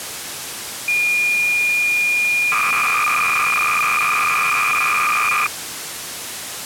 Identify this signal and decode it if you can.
Cassette data (Kansas City type), 300 baud, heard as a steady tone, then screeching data, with tape hiss.